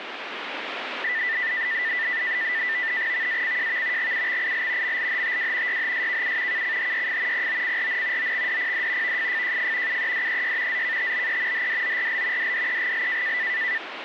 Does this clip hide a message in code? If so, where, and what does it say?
Yes: NAVTEX (SITOR-B), 100 baud, 170 Hz shift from 1.0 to 13.8 s, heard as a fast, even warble, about 1900 Hz centre, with radio static. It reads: VACJV GUXIL MLHTW YHSKU KCHYF POCRN OXDPD VFFJF UEDEY ZKTBE HDORL DDEGL